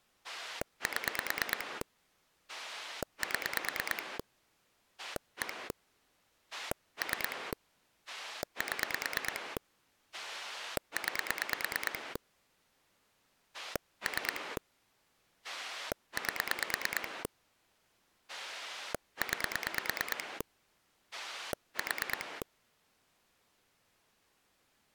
Pulse dialling, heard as a rotary dial, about 9 pulses a second. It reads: 7 7 1 3 7 9 3 8 9 4